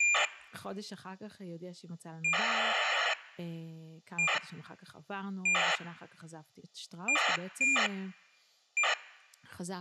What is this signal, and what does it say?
ACARS aircraft data, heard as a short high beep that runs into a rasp, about 2400 baud, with speech in Hebrew.